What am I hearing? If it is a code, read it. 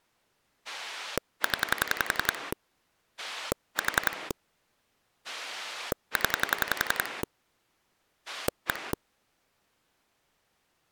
Pulse dialling, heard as a rotary dial, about 11 pulses a second. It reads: 0 4 0 1